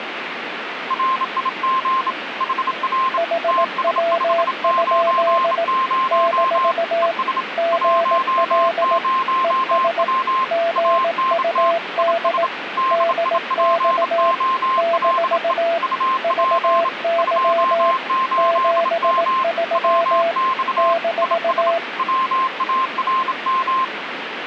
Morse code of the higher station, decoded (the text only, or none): RIG HR TS590 ES 10W ANT IS DIPOLE UP 28M WX IS WARM